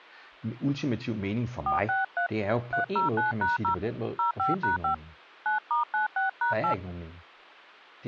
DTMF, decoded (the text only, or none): 463 309#0 05#5 9*96#8